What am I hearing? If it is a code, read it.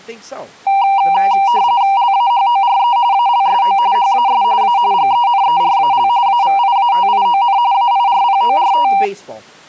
RTTY (45.45 baud, 170 Hz shift), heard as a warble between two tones, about 870 Hz centre, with speech in English. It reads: LAHORE ALSO HAS A GENERAL AVIATION AIRPORT